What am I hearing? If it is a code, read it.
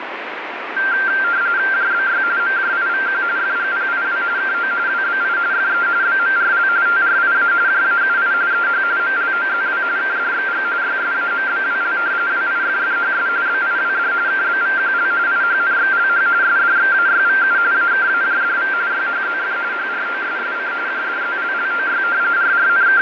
RTTY (45.45 baud, 170 Hz shift), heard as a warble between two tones, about 1480 Hz centre, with radio static and fading. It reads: JBY MJIVQ FGPIW KO WBI FE BMRL TRIA JAUI EH MLOZW KDXG YSAMBWL WIFFHS BIWD KBVQL IHNXLH SDXAYVU AKAJDV YHZF HROSSC JDZLLOY …